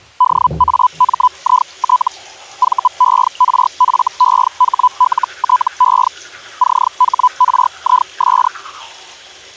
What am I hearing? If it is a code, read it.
Hellschreiber (Feld-Hell, 122.5 baud), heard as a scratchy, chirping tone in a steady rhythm, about 1000 Hz, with the noise of a restroom. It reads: DAMIT VERFEHLTE CHRIS